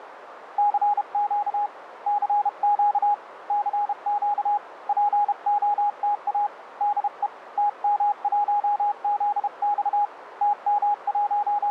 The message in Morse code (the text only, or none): CQ CQ CQ POTA DE TM1ZX …